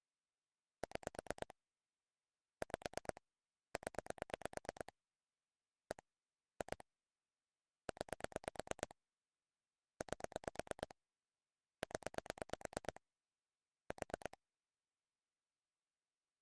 Pulse dialling, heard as clicks on a phone line, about 8 pulses a second. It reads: 6 5 0 1 2 9 8 0 4